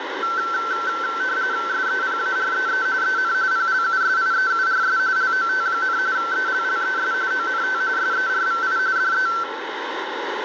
RTTY (45.45 baud, 170 Hz shift), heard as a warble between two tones, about 1440 Hz centre, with radio static and room echo. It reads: SEPAREE EN PLUSIEURS LOT, ELLES ONT SERVI DE